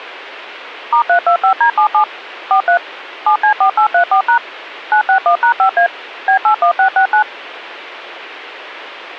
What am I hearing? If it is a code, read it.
DTMF, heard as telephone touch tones, dialled by machine, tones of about 100 ms. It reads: *325D77 43 7C4834# 961#5A B81669